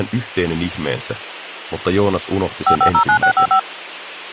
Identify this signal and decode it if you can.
DTMF, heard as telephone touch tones, dialled by machine, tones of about 90 ms, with hum. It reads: 5509655